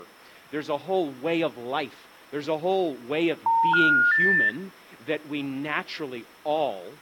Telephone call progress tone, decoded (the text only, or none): special information tone